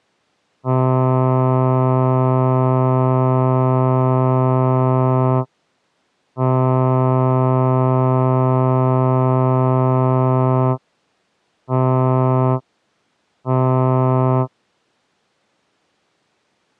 Ship horn signal, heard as a ship's horn, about 130 Hz. 2 long, 2 short. At sea: I intend to overtake on your port side.